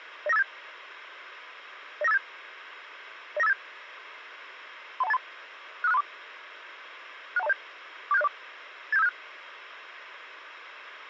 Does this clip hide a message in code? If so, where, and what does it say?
Yes: five-tone selective call (EIA) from 0.3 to 9.1 s, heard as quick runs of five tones, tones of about 30 ms, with radio hiss. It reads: 09587 09587 09587 31283 65634 61207 47604 87576